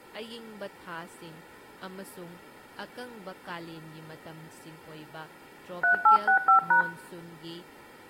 DTMF, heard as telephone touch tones, dialled by hand, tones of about 90 ms, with room echo and speech in Manipuri. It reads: 3865#